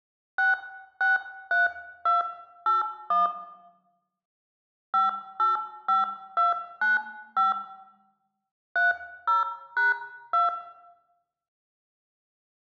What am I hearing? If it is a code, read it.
DTMF, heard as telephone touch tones, dialled by hand, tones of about 160 ms, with room echo. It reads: 663281 585295 30#2